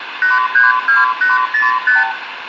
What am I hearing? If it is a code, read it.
Multi-frequency trunk signalling (R2, with the far end's replies), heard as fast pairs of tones, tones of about 160 ms, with phone line noise and room echo. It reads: 832805